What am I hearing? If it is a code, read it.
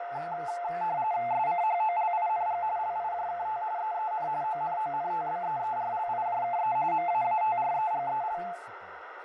RTTY (45.45 baud, 170 Hz shift), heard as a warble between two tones, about 780 Hz centre, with radio static, fading, a narrow filter and speech in English. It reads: SCHOLING LIJKT EEN ONONTBEERLIJKE MAATREGEL